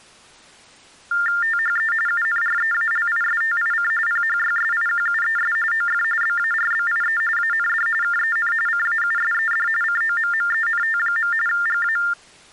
TTY/TDD text telephone tones (45.45 baud Baudot), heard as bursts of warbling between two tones, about 400 Hz shift, 1600 Hz centre. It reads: THE UNREALISTIC PHYSIQUES OF BARBIE AND KEN CAUSED COMMENT. GA